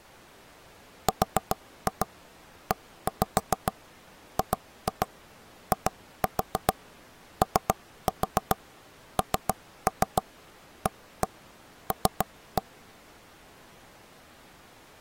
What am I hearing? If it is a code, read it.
Tap code, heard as knocks on wood, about 7 knocks a second. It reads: REGIONAL